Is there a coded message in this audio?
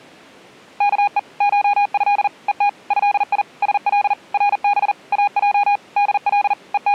Yes: Morse code (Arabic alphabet) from 0.7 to 6.9 s, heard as a keyed tone, machine-sent, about 40 wpm, 820 Hz. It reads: كء شه ءت هي سل رب اج دل …